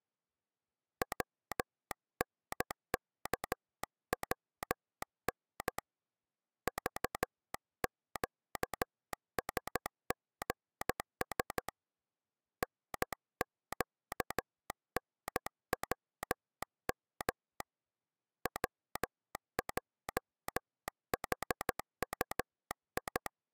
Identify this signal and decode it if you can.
Morse code, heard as a telegraph sounder, hand-sent with a paddle, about 13 wpm. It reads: WNKWN VQSGS NQNWM WJHUI